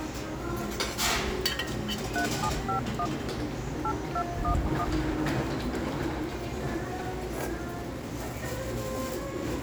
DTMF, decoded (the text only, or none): 3751 8211